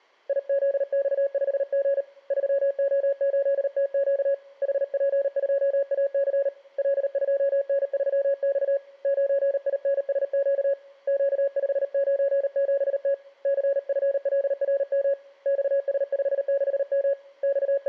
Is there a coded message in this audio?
Yes: Morse code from 0.2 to 17.9 s, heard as a keyed tone, hand-sent with a paddle, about 38 wpm, 560 Hz. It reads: IZX5G 3O8TQ HP2AC L2N3X 9INSQ Q597T CFLRM XS56M …